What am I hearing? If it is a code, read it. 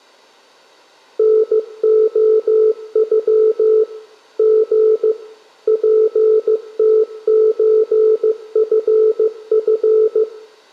Morse code (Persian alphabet), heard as a keyed tone, machine-sent, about 15 wpm, 440 Hz, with room echo. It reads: نعغ ژ پتچفف